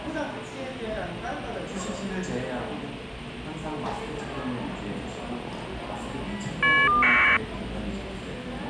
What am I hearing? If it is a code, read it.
Caller ID data burst, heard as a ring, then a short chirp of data, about 1200 baud, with the noise of a cafe.